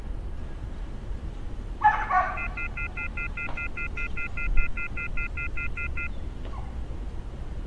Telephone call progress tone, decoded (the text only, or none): off-hook warning tone